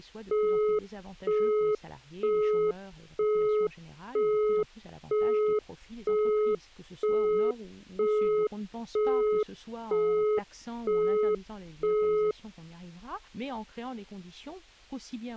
Telephone call progress tone (single-tone plan, as in Europe, Japan and elsewhere), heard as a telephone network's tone, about 420 Hz, 0.48 s on and 0.48 s off. Busy tone.